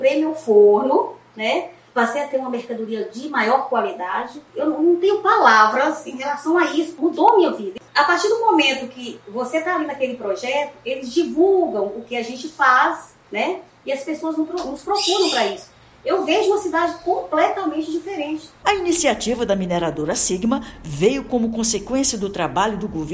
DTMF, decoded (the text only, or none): none